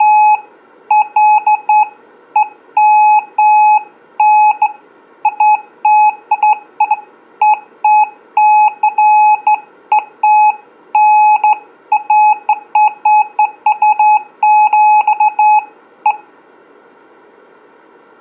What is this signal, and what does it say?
Beeps of irregular length. There is no code.